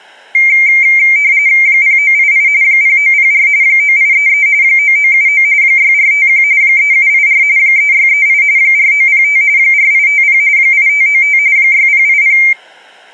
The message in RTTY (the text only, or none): 0988 0904 9833 9979 6451 3784 3638 4905 4850 8595 6080